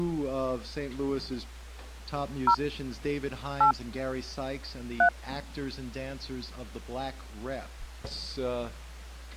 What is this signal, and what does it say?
DTMF, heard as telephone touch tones, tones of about 80 ms. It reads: 0 8 3